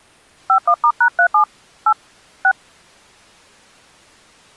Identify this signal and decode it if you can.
DTMF, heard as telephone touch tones, dialled by hand, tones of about 80 ms. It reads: 51*#37 8 6